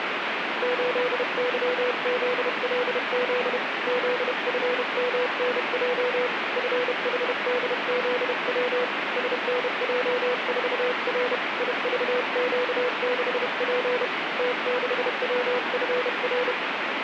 Morse code, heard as a keyed tone, hand-sent with a paddle, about 31 wpm, 500 Hz, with radio static. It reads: 8YZLZ ZFMNJ FHDZW SNJ4R IVQ6P T6WFR